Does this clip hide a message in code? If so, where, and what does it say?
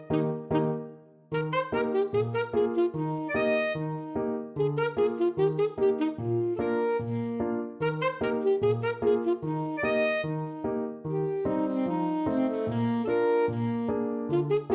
No.